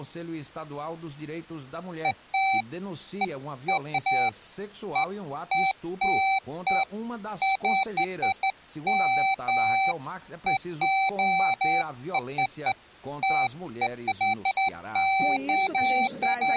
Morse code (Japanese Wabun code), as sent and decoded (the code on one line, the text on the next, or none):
none